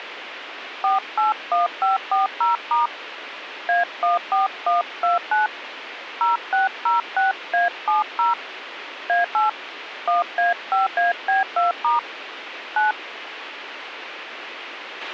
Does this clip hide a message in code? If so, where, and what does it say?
Yes: DTMF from 0.8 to 12.9 s, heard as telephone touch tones, dialled by hand, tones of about 150 ms, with radio hiss and a squelch burst at the end. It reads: 481540* A14129 0606A70 A8 1A5AB2* 9